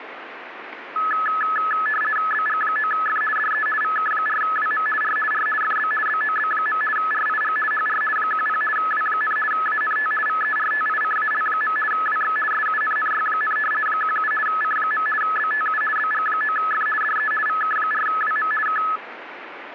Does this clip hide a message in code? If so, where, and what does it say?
Yes: RTTY (50 baud, 450 Hz shift) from 1.0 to 19.0 s, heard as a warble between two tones, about 1500 Hz centre, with radio static. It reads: BG9F DE VK4WM R R FB BOB. RIG HR 10 W, ANT VERTICAL. WX SUNNY, 17 C. BTU BG9F DE VK4WM K